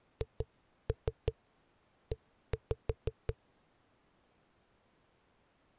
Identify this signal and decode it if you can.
Tap code, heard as knocks on a wall, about 5 knocks a second. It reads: HE